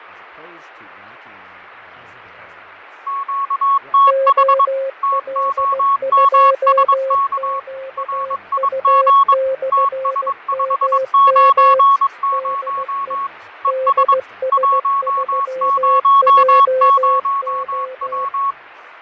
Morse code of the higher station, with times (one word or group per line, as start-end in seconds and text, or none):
3.1-4.6 QTH
5.0-7.6 TOMSK
8.0-9.3 RIG
9.7-13.3 TS590
13.6-14.1 ES
14.5-18.5 100W